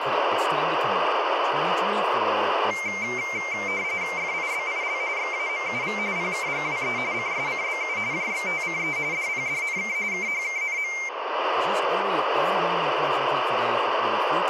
RTTY (45.45 baud, 170 Hz shift), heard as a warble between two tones, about 2200 Hz centre, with radio static and speech in English. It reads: FIBIL XAMUV PKGWE CSCBU JXTCE DPDNK KHKNM